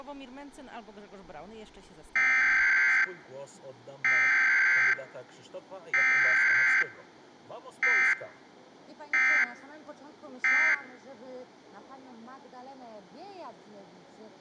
Emergency Alert System (SAME) tones (header bursts, then end-of-message bursts), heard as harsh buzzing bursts, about 520.83 baud.